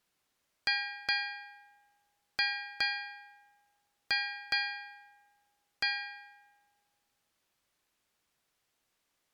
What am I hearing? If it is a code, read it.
Ship's bell, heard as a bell. 7. Seven half-hours of the watch have passed.